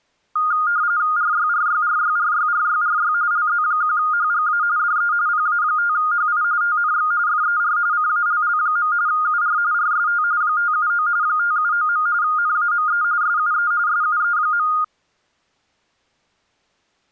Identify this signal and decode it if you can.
RTTY (45.45 baud, 170 Hz shift), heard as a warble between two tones, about 1330 Hz centre. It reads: RYRYRYRYRYRY LZ1HGA DE PA5HI TNX FER CALL. UR RST 579 579. NAME SUE SUE.